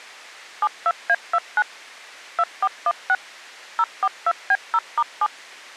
DTMF, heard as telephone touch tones, dialled by machine, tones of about 50 ms. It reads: 72A29 2416 042B0*7